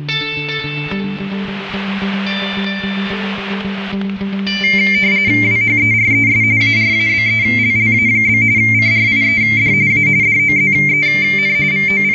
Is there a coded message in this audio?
Yes: RTTY (45.45 baud, 170 Hz shift) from 4.6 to 12.1 s, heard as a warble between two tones, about 2200 Hz centre, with static crashes. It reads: WHERES ARABELLA? CRIED A DOZEN …